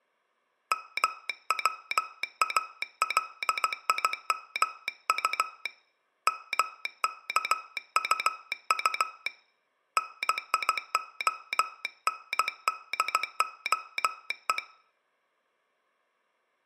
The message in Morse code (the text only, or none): MWALIMU MKUU NIONDOE